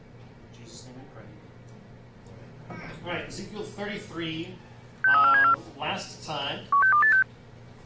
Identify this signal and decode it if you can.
Five-tone selective call (CCIR), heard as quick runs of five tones, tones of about 100 ms. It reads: 63474 16286